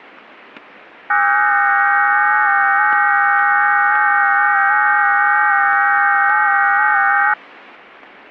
FT8 (several signals at once), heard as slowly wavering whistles, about 6.25 baud, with static crashes.